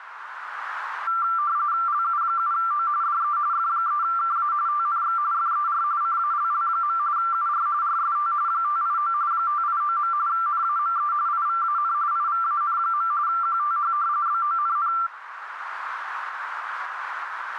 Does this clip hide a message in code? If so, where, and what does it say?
Yes: RTTY (45.45 baud, 170 Hz shift) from 1.1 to 15.1 s, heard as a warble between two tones, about 1270 Hz centre, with radio static. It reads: LU7O DE F3KA TNX FER CALL. UR RST 589 589. NAME IVAN IVAN. QTH BONN